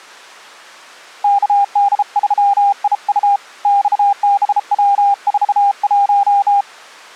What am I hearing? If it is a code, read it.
Morse code, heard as a keyed tone, hand-sent with a bug key, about 33 wpm, 800 Hz. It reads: KD3IU XBW41